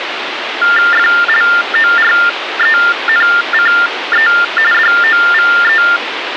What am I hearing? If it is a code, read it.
TTY/TDD text telephone tones (45.45 baud Baudot), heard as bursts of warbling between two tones, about 400 Hz shift, 1600 Hz centre, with phone line noise. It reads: FLORENCE DOVE